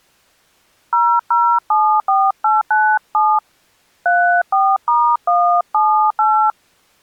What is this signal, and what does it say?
DTMF, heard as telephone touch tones, dialled by hand, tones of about 260 ms. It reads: 0074897 34*178